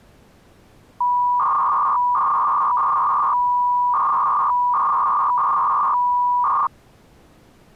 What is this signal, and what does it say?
300-baud modem data (V.21 tones), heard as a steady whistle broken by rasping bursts, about 300 baud, 200 Hz shift.